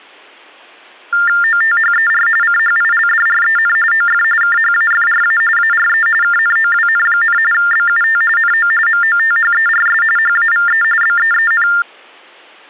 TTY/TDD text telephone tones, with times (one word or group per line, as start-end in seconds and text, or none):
1.4-2.3 OTHER
2.4-3.8 CHILDREN
3.9-4.2 OF
4.4-5.4 KHAFRA
5.6-6.1 ARE
6.2-7.4 KNOWN,
7.5-8.2 BUT
8.4-8.7 NO
8.9-10.0 MOTHERS
10.2-10.8 HAVE
11.0-11.7 BEEN